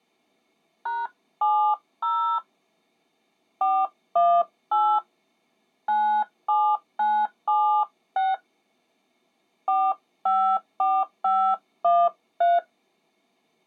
DTMF, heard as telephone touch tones, dialled by hand, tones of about 270 ms. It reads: #70 418 97976 454513